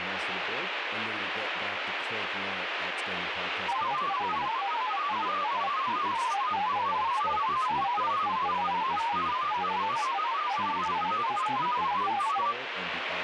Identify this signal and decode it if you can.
Multi-tone FSK (Olivia or MFSK type), about 500 Hz wide, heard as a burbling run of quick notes, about 31.25 baud, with radio static and speech in English.